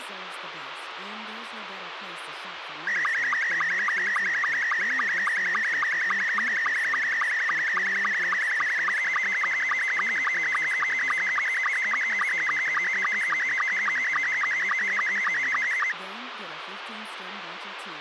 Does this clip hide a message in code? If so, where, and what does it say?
Yes: SSTV (slow-scan television), Scottie S2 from 2.9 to 15.9 s, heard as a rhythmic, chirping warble, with radio hiss and speech in English.